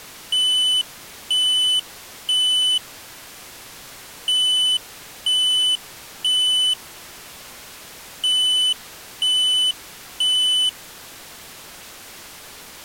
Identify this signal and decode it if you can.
Alarm pattern, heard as an alarm's beeps, played three times, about 3000 Hz. Temporal three. Smoke or fire, evacuate.